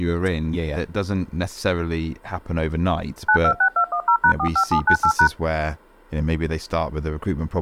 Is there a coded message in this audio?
Yes: DTMF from 3.3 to 5.3 s, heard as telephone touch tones, dialled by machine, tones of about 80 ms, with speech in English. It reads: 926210#45798#